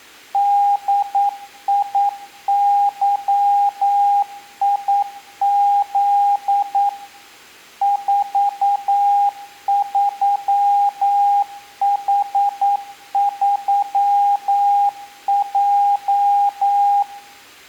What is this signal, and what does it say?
Morse code, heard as a keyed tone, machine-sent, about 9 wpm, 810 Hz, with room echo. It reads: DIYIZ 43H3J